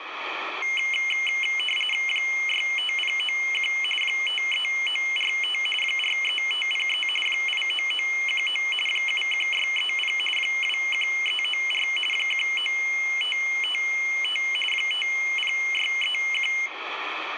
RTTY (45.45 baud, 850 Hz shift), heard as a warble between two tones, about 2550 Hz centre, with radio static and room echo. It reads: 65091 53945 43503 89919 71630 21394 19555 50631